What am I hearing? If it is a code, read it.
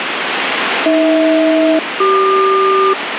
Aircraft SELCAL, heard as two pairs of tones, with radio static. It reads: AH-CQ